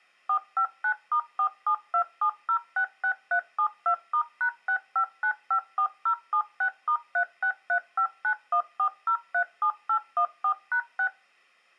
DTMF, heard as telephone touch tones, dialled by machine, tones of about 80 ms. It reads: 459*4727066372*#65954076*3635914037814#6